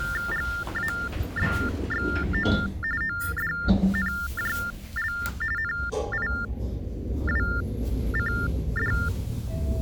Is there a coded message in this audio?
Yes: TTY/TDD text telephone tones (45.45 baud Baudot) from 0.0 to 9.1 s, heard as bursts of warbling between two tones, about 400 Hz shift, 1600 Hz centre, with the noise inside a lift. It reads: GABXO ODNJL NIWCD